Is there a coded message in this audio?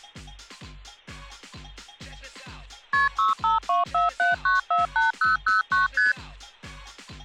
Yes: multi-frequency trunk signalling (R1, as on North American trunks) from 2.9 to 6.1 s, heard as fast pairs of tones, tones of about 150 ms. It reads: KP 65247948009 ST